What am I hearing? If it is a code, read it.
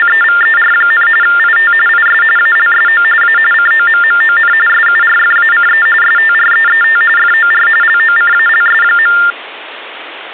TTY/TDD text telephone tones (45.45 baud Baudot), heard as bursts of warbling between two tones, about 400 Hz shift, 1600 Hz centre. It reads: … IT IS ALSO A COMMON SURFACE STREET FOR LOCALS.